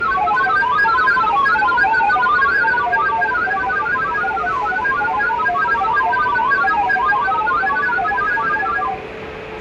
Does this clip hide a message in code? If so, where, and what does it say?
Yes: multi-tone FSK (Olivia or MFSK type), about 1000 Hz wide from 0.0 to 9.0 s, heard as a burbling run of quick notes, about 31.25 baud, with radio static, a steady whistle near 440 Hz, room echo and the noise of a crowd indoors.